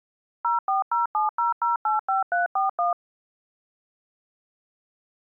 DTMF, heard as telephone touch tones, dialled by machine, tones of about 140 ms. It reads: 04070085341